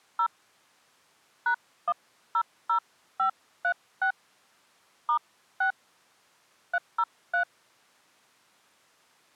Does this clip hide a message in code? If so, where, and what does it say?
Yes: DTMF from 0.2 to 7.4 s, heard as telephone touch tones, dialled by hand, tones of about 80 ms. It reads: 0 #100536 *6 303